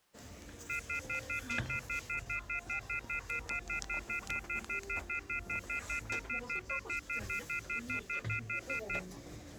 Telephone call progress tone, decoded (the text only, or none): off-hook warning tone